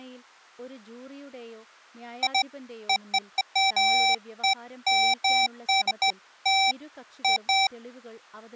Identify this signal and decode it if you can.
Beeps of irregular length, with speech in Malayalam. There is no code.